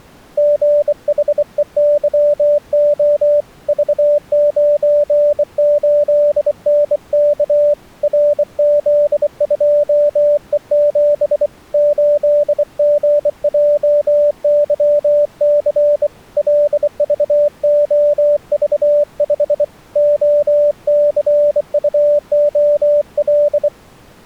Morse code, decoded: GHEYO V98NK RZ2E7 8GJYC LVOV5 OCUOL

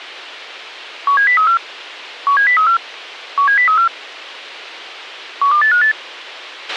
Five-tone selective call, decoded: 17034 17034 17034 12858

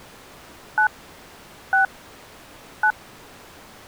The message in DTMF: 9 6 9

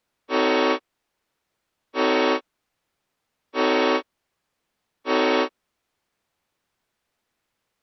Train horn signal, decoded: 4 short

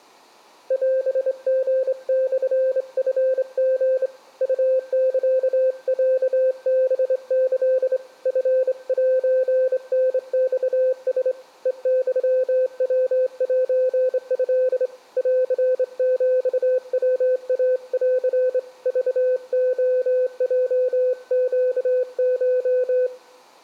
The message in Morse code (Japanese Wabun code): オリモチリ ウサロハキ チセタマラ ヘユヤセト ンヒヤイン クレヲネコ

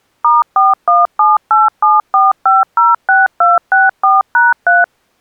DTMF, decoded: *417874506264#3

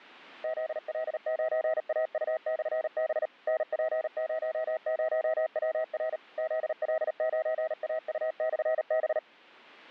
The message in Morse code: ZL9AU/B NP00WR ZL9AU/B

